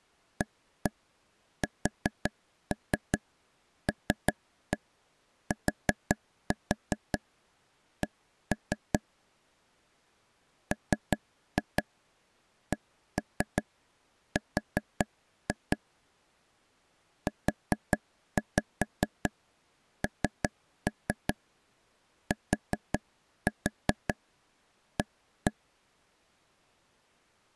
Tap code, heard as taps on a table, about 5 knocks a second. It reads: ASLTC MCR UNTA